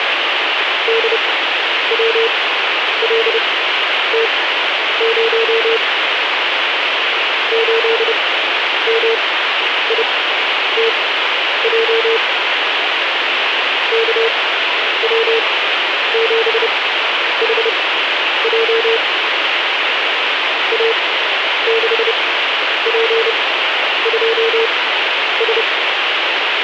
Morse code, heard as a keyed tone, machine-sent, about 30 wpm, spaced as for 10 wpm, 450 Hz, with radio static. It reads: DWLT0 8MITJ KW7HJ A6P2S